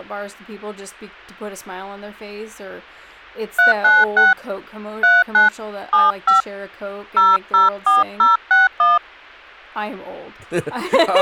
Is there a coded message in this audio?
Yes: DTMF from 3.6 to 9.0 s, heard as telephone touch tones, dialled by hand, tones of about 160 ms, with speech in English. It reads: 396 39 75 004061